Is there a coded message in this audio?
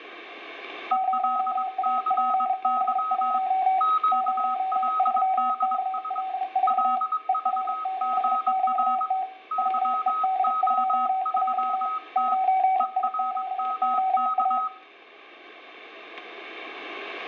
Yes: Morse code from 0.9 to 14.7 s, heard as two keyed tones, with static crashes and room echo. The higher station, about 22 wpm, 1270 Hz: ELCY QLDS LVGR YO3T ERMK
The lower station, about 33 wpm, 760 Hz: 0APB1 03KL4 ER7QT WED2J 9IQOA